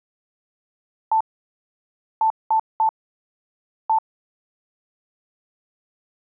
Beep code, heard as beeps, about 880 Hz. 1-3-1. In Phoenix BIOS tables: memory refresh failure.